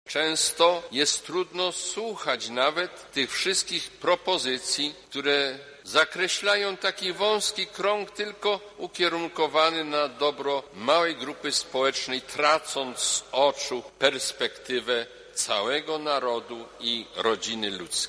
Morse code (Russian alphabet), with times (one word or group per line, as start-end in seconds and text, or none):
none